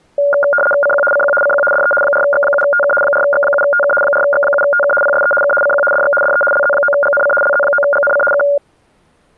RTTY (75 baud, 850 Hz shift), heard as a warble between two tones, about 1000 Hz centre. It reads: CQ CQ CQ DE 4X7TK 4X7TK 4X7TK PSE K CQ DX DE LZ9GNC LZ9GNC K